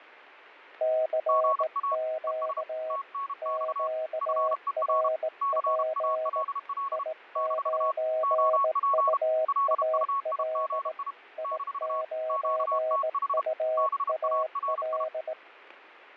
Morse code, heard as two keyed tones. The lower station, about 18 wpm, 630 Hz: CQ QRP I9UAL I9UAL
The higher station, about 32 wpm, 1110 Hz: GA ES TNX FER CALL - OP LUIGI - QTH BARI